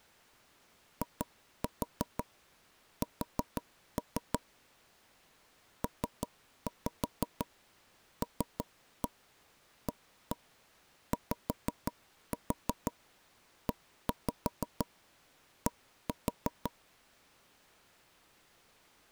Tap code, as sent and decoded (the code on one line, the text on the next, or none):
2-4 4-3 / 3-5 3-1 1-1 5-4 1-5 1-4
IS PLAYED